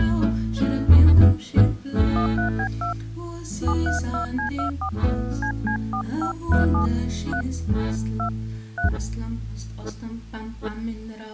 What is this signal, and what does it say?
DTMF, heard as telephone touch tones, dialled by hand, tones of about 100 ms. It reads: 13B2 732C24 CC4537 3 2 3